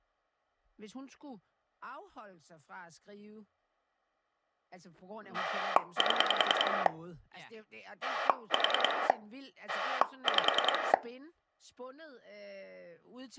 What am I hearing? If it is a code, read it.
Pulse dialling, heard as a rotary dial, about 10 pulses a second, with speech in Danish. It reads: 7 4 5